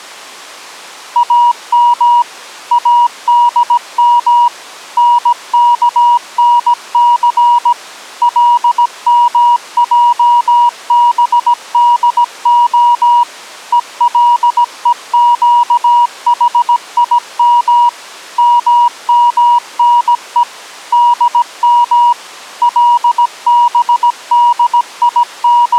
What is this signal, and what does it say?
Morse code (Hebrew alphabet), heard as a keyed tone, machine-sent, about 17 wpm, 960 Hz. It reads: אם אדם נכנס למעבדה ולוקחים ממנו דם …